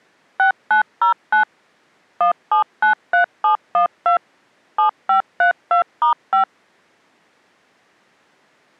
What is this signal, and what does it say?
DTMF, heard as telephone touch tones, dialled by machine, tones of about 110 ms. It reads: 6909 1793712 7532*5